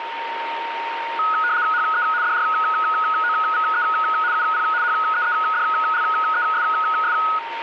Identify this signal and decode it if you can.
RTTY (75 baud, 170 Hz shift), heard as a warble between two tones, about 1360 Hz centre, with radio static and a steady whistle near 920 Hz. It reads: HE DROVE UP HEEDLESS